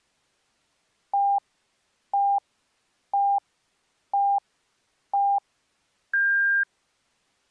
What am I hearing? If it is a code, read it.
Radio time signal (five pips and a higher one, as on Chinese radio), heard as pips.